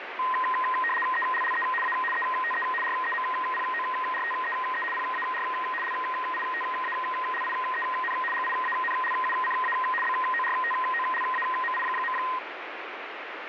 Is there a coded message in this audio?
Yes: RTTY (75 baud, 850 Hz shift) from 0.2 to 12.4 s, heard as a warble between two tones, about 1450 Hz centre, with radio static. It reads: ELLE A ETE REMPORTEE PAR LITALIEN GIANLUCA BORTOLAMI.